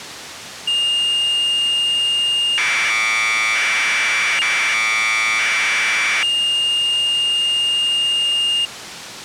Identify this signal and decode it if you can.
Commodore tape loading (standard loader), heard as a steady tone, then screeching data.